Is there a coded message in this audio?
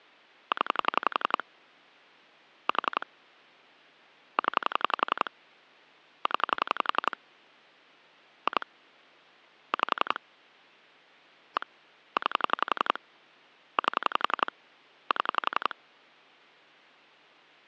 Yes: pulse dialling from 0.5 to 15.7 s, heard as clicks on a phone line, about 11 pulses a second. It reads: 0 4 0 0 2 5 1 9 8 7